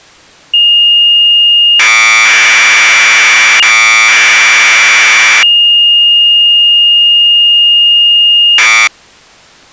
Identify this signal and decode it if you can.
Commodore tape loading (standard loader), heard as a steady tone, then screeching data.